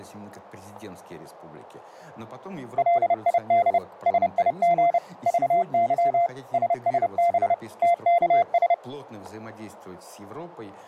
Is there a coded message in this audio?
Yes: Morse code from 2.7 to 8.8 s, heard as a keyed tone, machine-sent, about 30 wpm, 690 Hz, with static crashes. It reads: LID SIG VY SSB TKS